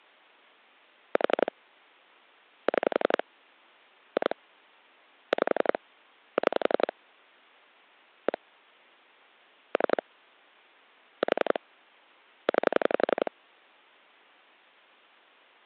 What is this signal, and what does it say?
Pulse dialling, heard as clicks on a phone line, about 11 pulses a second. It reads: 4 6 2 5 6 1 3 4 9